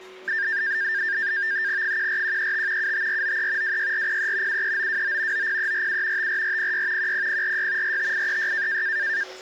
NAVTEX (SITOR-B), 100 baud, 170 Hz shift, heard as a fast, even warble, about 1700 Hz centre, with a steady whistle near 370 Hz and the noise of a cafe. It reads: 14135 75493 26403 73929 90347 54406 10046 45836